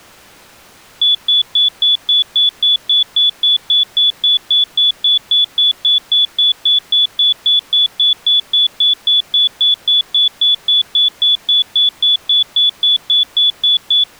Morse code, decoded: none

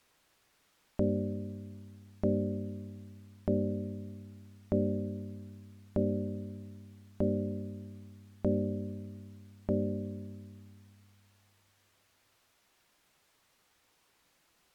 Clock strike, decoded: 8

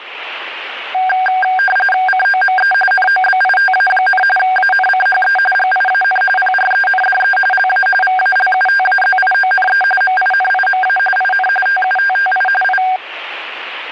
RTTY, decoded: COME NOBITA, ANCHE GIAN PRENDE LA VALUTAZIONE MINIMA IN TUTTI I

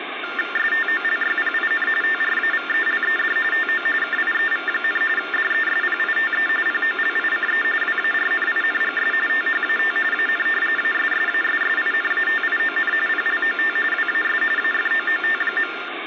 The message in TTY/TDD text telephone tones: STOLYPIN TRAVELED TO KIEV, DESPITE POLICE WARNINGS THAT AN ASSASSINATION PLOT WAS AFOOT.

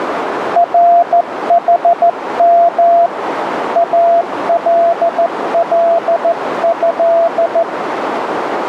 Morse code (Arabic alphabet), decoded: رحم الله

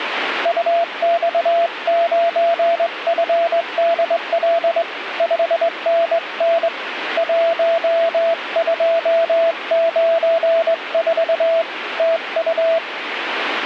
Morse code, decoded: UX9FDL 5NN 1294 TU

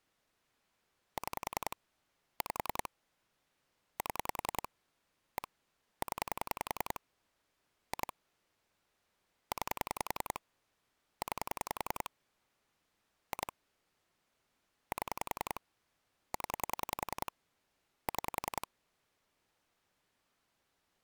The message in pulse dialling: 6 5 7 1 0 2 9 9 2 7 0 6

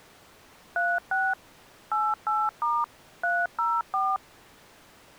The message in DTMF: 36 88* 304

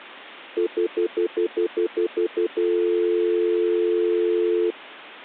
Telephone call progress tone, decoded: stutter dial tone

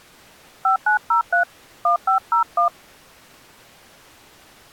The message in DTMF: 5903 1501

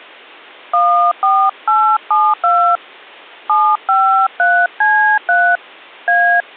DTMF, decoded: 14872 753C3 A

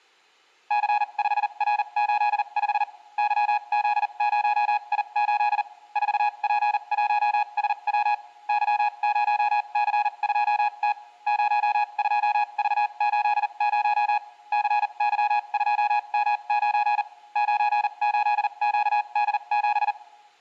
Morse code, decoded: C5R85 YZ0I8 4P1SW Y0C2T 02V80 CY2M9 98QD7

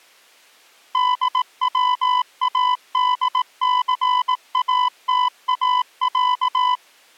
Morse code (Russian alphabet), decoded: ДВАДЦАТАЯ

